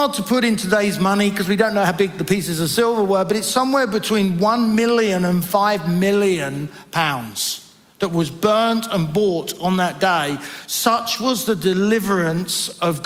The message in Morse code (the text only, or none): none